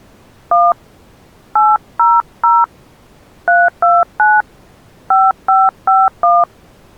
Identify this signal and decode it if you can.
DTMF, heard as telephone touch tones, dialled by hand, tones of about 210 ms. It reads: 1 800 329 5551